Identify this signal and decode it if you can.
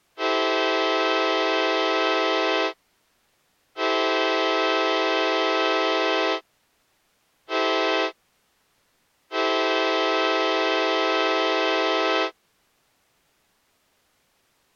Train horn signal, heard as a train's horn. 2 long, 1 short, 1 long. On North American railways: approaching a public crossing.